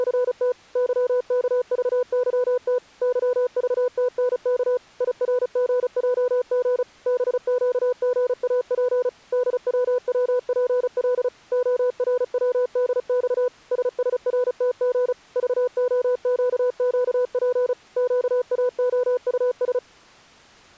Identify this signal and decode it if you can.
Morse code, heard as a keyed tone, machine-sent, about 35 wpm, 500 Hz. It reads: … YKVYT YVTNK IRGJG BQGAP DWWPL ORWDX SSRTG VOQQP QAOUS